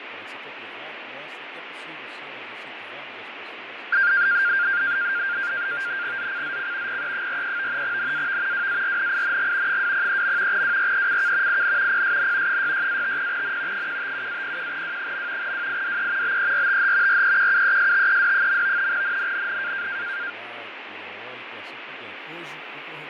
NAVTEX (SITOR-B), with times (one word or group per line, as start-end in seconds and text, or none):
6.2-7.0 ZCZC
6.9-7.8 PE43
7.8-8.7 NAV
8.5-9.8 WARNING
9.7-10.6 203.
10.5-11.6 WRECK
11.5-12.0 IN
11.9-12.6 PSN
12.5-13.9 66-50N
13.7-15.5 157-01W.
15.4-16.4 WIDE
16.2-17.2 BERTH
17.1-18.9 REQUESTED.
18.9-19.9 NNNN